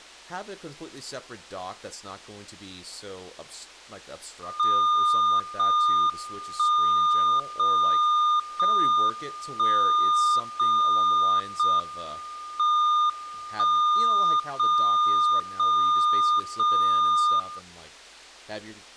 Radio time signal (JJY), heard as a tone whose level steps once a second, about 1210 Hz, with speech in English. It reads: 0 1 0 0 1 0 0 M 1 0 0 0 0